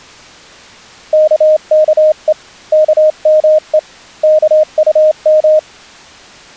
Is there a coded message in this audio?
Yes: Morse code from 1.1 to 5.7 s, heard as a keyed tone, hand-sent with a straight key, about 27 wpm, 620 Hz. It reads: KKE KME KUM